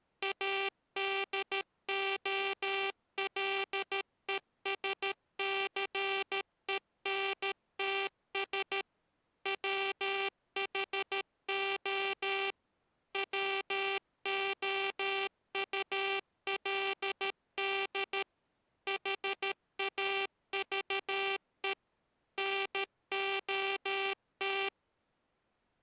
Morse code, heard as a buzzer, machine-sent, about 13 wpm. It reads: ADOLESCENTS WHO WOULD HAVE NOT